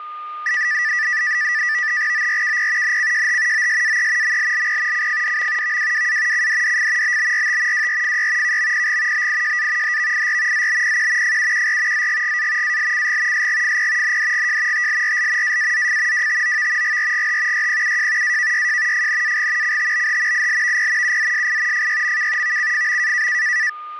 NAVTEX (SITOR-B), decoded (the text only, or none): ORKP NCJH OSAE MLLP CFDM VWWA CDDF BBRT WRFY KMPG BIJA HVIR ZBPQ FUQR ZGGA ALCG SGFP NDGJ TLRL AAZF WTOV GRGH YPUJ AKYJ FNAG CTBH ILVP UZSI FYMK VCFM